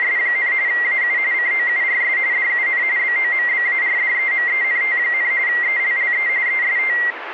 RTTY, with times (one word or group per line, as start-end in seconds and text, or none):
0.0-0.5 …
0.7-1.2 AU
1.3-2.2 COURS
2.3-2.8 DUN
3.0-5.3 BOMBARDEMENT,
5.5-6.3 ELLE
6.5-7.0 EST